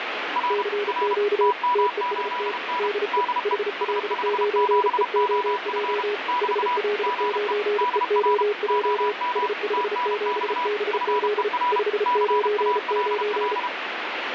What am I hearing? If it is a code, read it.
Morse code, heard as two keyed tones, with radio static. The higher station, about 32 wpm, 980 Hz: R R TM8N DE S57OF <BT> GE DR OM TNX FER CALL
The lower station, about 34 wpm, 420 Hz: CQ TEST DE HL9EOJ HL9EOJ S57BZ 599